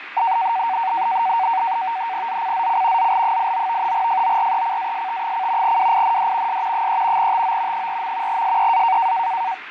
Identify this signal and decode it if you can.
NAVTEX (SITOR-B), 100 baud, 170 Hz shift, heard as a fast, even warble, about 840 Hz centre, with radio static, fading and speech in English. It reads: ZCZC ZL89 FORECAST: WIND S 3 TO 4. SEA